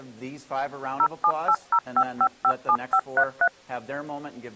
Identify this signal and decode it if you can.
DTMF, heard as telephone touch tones, dialled by machine, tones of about 70 ms. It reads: 07805557533